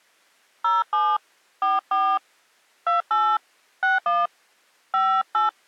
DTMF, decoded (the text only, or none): 07 44 28 61 58